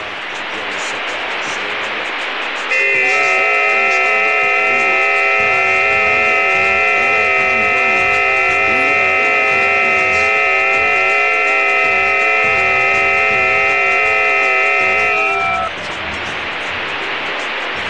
FT8 (several signals at once), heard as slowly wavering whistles, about 6.25 baud, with radio static.